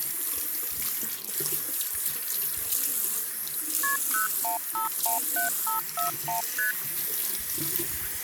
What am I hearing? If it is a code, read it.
Multi-frequency trunk signalling (R1, as on North American trunks), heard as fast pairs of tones, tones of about 130 ms, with the noise of a restroom. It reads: KP 01517541 ST